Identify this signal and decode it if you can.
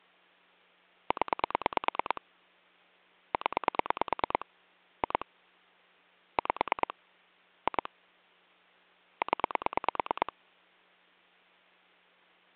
Pulse dialling, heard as clicks on a phone line, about 9 pulses a second. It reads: 0 0 2 5 2 0